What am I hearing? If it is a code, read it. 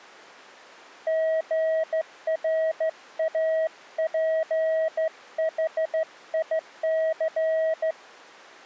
Morse code, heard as a keyed tone, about 14 wpm, 640 Hz. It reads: GRAPHIC